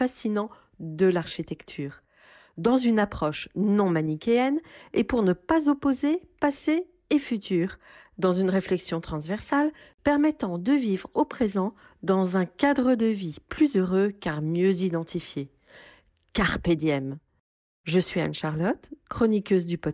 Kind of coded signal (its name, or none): none